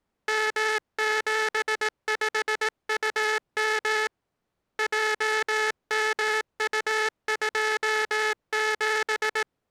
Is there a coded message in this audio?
Yes: Morse code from 0.2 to 9.5 s, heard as a buzzer, hand-sent with a paddle, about 18 wpm. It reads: M75UM JMU27